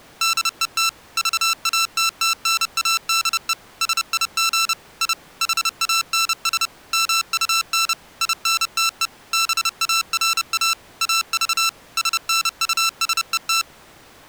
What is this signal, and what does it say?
Morse code, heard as electronic beeps, machine-sent, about 30 wpm, 1340 Hz. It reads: DET VATTNADE SIG I HANS MUN INTE BARA AV SNUSET